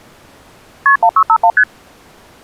Multi-frequency trunk signalling (R1, as on North American trunks), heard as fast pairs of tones, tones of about 70 ms. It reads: KP 1651 ST